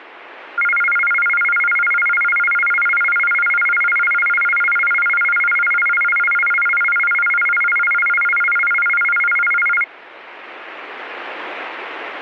A tone that alternates evenly between two pitches. There is no code.